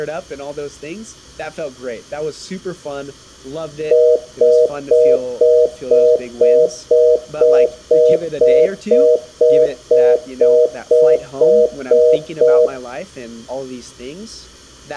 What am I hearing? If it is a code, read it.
Telephone call progress tone (North American plan), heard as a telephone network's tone, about 480, 620 Hz, 0.25 s on and 0.25 s off, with room echo and speech in English. Congestion tone.